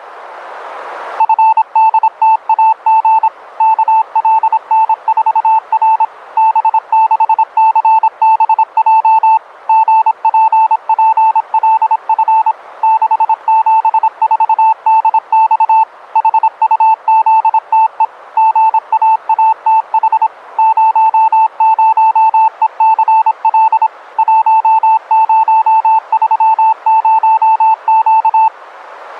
Morse code, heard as a keyed tone, machine-sent, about 26 wpm, 880 Hz. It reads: FDTAG KLN4R B6CBJ GPPLF 674DX HUZTE GAATH 00ECL 1030Q